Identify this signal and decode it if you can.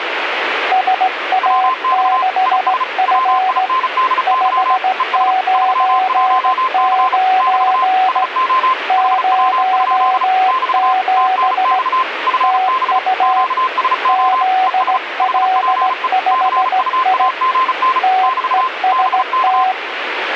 Morse code, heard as two keyed tones, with radio static. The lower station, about 17 wpm, 750 Hz: SA6F 599 07 TU ZL5I TEST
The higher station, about 35 wpm, 1040 Hz: WX IS WINDY ES 31C <BT> SO HW? <BT> TNX FB QSO ES HPE CUAGN <BT> BK